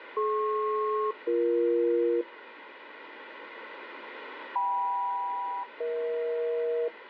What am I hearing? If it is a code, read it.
Aircraft SELCAL, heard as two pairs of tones, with radio static. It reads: DP-BE KM-EH